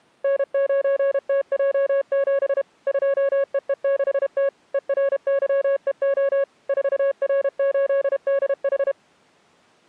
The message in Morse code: N9TJ7 2EE6T ERYEO 4R8DH

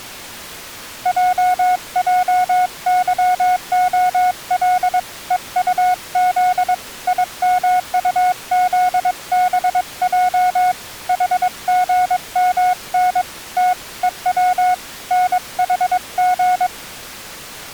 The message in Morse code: JJYOL EUZ IMUZBJ HGMN T EW NHG

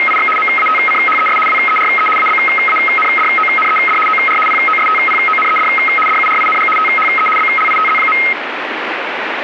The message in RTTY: … MATCHES WERE ABANDONED OR POSTPONED DURING THE BLITZ.

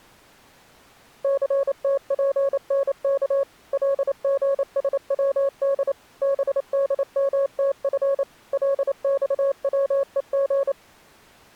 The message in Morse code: CTPNK LGSWD BDMTF LXWEG

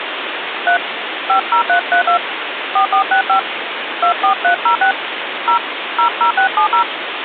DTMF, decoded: 3 50332 4465 24306 0 00670

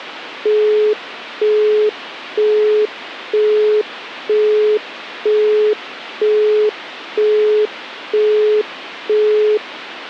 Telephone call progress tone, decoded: busy tone

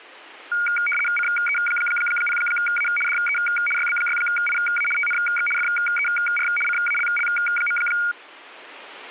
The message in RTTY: CE0A DE YB6IA TNX FER CALL.

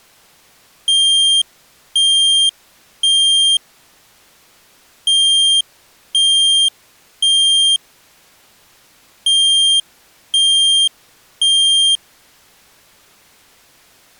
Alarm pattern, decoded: temporal three

